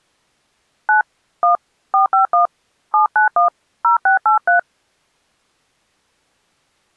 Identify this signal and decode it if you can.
DTMF, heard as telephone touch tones, dialled by hand, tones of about 120 ms. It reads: 9 1 451 791 0683